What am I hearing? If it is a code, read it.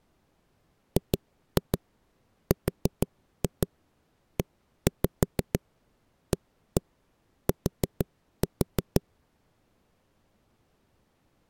Tap code, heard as knocks on a wall, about 6 knocks a second. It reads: GREAT